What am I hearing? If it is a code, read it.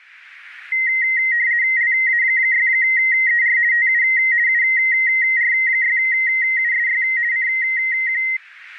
RTTY (50 baud, 170 Hz shift), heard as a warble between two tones, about 2000 Hz centre, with radio static. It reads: LA6ER TU UR6USY CQ